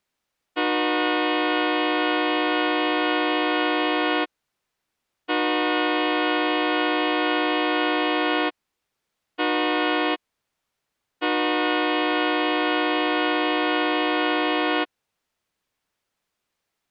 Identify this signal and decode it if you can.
Train horn signal, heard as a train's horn. 2 long, 1 short, 1 long. On North American railways: approaching a public crossing.